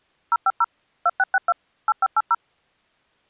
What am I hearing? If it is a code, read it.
DTMF, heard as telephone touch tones, dialled by machine, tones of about 40 ms. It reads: 050 2662 8580